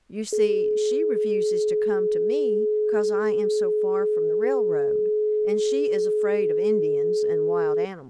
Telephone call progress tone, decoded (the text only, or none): dial tone